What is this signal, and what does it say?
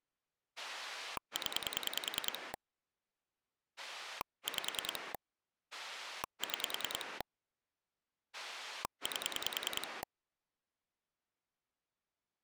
Pulse dialling, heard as a rotary dial, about 10 pulses a second. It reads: 0 5 6 8